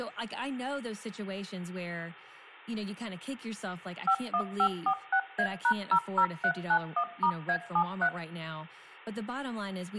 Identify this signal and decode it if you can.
DTMF, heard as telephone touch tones, dialled by machine, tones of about 80 ms, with hum and speech in English. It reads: 51546A#00391*A73